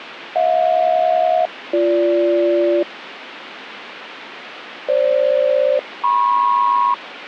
Aircraft SELCAL, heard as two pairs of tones, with radio static. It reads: HJ-BG FG-MP